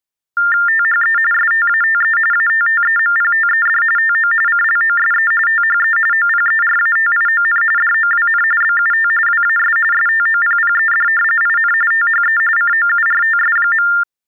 TTY/TDD text telephone tones (45.45 baud Baudot), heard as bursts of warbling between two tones, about 400 Hz shift, 1600 Hz centre. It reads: THE STATE ATTEMPTED TO CLOSE THE OPERATION DOWN BUT WAS STOPPED IN THE COURTS.